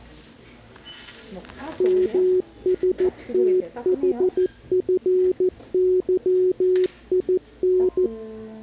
Morse code (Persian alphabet), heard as a keyed tone, machine-sent, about 14 wpm, 370 Hz, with the noise of a crowd indoors. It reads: مستحفظین